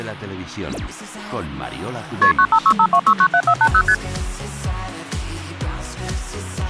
Multi-frequency trunk signalling (R1, as on North American trunks), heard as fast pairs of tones, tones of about 70 ms. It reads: KP 95652697480 ST